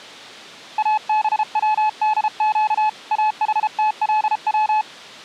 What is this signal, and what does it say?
Morse code (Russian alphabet), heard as a keyed tone, hand-sent with a paddle, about 33 wpm, 860 Hz. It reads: АБВДЩ АХТЛВ